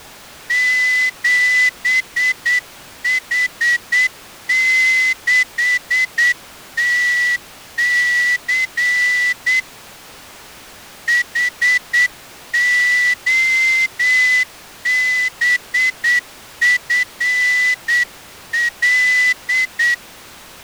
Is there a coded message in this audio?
Yes: Morse code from 0.4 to 20.0 s, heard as a whistle, hand-sent with a straight key, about 8 wpm. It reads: 7H6TC HOBFL